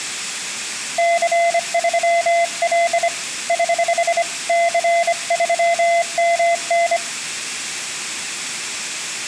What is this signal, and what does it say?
Morse code, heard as a keyed tone, hand-sent with a bug key, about 25 wpm, 680 Hz, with room echo. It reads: C3L <HH> C3MN